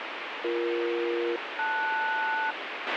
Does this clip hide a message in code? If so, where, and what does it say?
Yes: aircraft SELCAL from 0.4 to 2.5 s, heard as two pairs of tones, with radio hiss and a squelch burst at the end. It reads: BE-LS